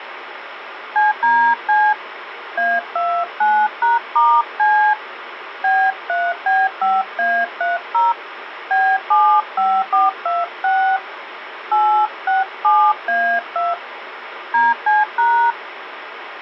DTMF, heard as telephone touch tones, dialled by hand, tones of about 250 ms, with phone line noise. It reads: CDC A29#*C B3B5A30 B75426 867A2 DC#